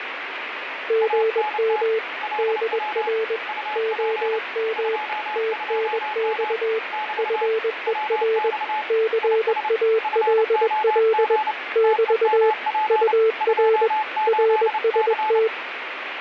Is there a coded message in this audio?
Yes: Morse code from 0.8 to 15.5 s, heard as two keyed tones, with radio static and fading. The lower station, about 21 wpm, 440 Hz: GM DR OM TNX FER CALL <BT> UR RST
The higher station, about 29 wpm, 860 Hz: ANT LW UP 22M <BT> WX IS FOG TEMP 28C